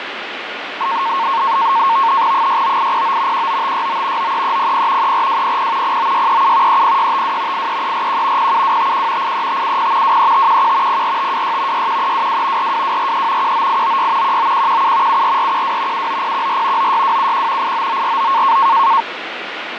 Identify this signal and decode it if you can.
NAVTEX (SITOR-B), 100 baud, 170 Hz shift, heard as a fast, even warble, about 1000 Hz centre, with radio static and fading. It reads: 69809 19569 93300 34200 09637 30652 83341 07251 83570 23511 04526 61322 42243 19896 19117 74412 79014 96271 89949